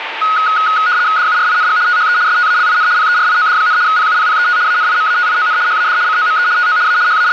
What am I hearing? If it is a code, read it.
RTTY (75 baud, 170 Hz shift), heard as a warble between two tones, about 1360 Hz centre, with radio static and a steady whistle near 900 Hz. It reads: DURING THE STALIN PERIOD, PUPPET ANIMATION HAD COME TO A …